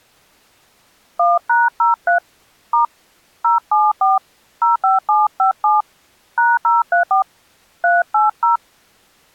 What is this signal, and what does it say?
DTMF, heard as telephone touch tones, dialled by hand, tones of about 160 ms. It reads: 1#03 * 074 05757 #034 380